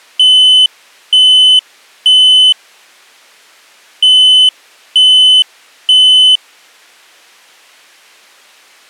Alarm pattern, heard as an alarm's beeps, played twice, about 3050 Hz. Temporal three. Smoke or fire, evacuate.